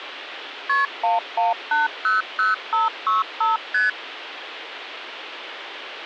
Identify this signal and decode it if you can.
Multi-frequency trunk signalling (R1, as on North American trunks), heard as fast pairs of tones, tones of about 160 ms, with phone line noise. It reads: KP 11800565 ST